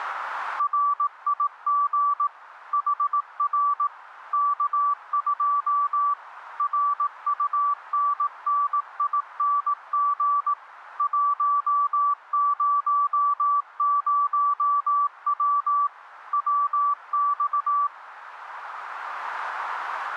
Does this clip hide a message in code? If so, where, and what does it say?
Yes: Morse code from 0.5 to 17.9 s, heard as a keyed tone, machine-sent, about 18 wpm, 1160 Hz, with radio static. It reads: RIG HR K2 RUNNING 100W WX